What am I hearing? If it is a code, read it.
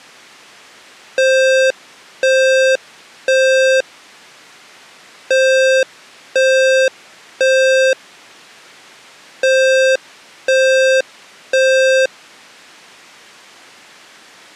Alarm pattern, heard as an alarm's beeps, played three times, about 530 Hz. Temporal three. Smoke or fire, evacuate.